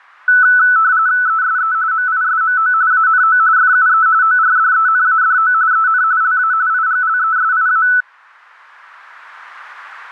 RTTY (45.45 baud, 170 Hz shift), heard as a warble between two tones, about 1400 Hz centre. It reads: ESE MISMO ANO FUE ORDENADO EN LA IGLESIA